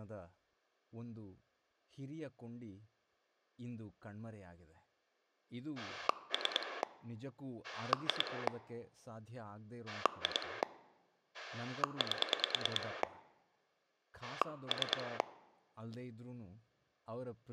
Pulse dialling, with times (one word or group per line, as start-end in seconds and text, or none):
5.8-6.8 3
7.6-8.5 2
9.9-10.6 2
11.3-13.0 8
14.2-15.2 3